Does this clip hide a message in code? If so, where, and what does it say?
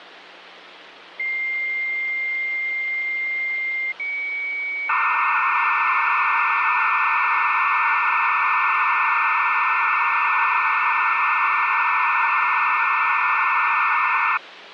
Yes: dial-up modem handshake (low-speed, two carriers) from 1.2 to 14.4 s, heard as two whistles, then hiss, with phone line noise.